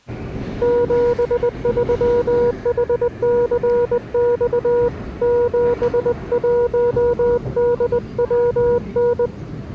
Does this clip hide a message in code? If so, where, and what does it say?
Yes: Morse code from 0.6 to 9.3 s, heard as a keyed tone, hand-sent with a bug key, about 20 wpm, 480 Hz, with the noise inside a subway train. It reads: 73HCX 71DWN